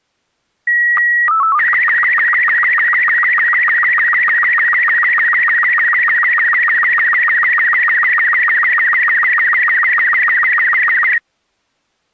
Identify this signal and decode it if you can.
SSTV (slow-scan television), Robot 36, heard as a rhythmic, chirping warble.